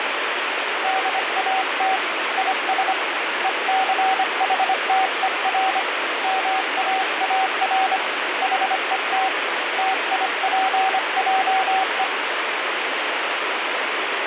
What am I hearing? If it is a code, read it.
Morse code, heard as a keyed tone, hand-sent with a paddle, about 25 wpm, 760 Hz, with heavy radio static. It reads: DAT IS ECHTER MAAR HET TIPJE